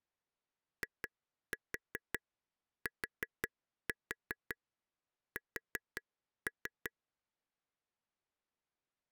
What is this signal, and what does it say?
Tap code, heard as taps on a table, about 5 knocks a second. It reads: ITS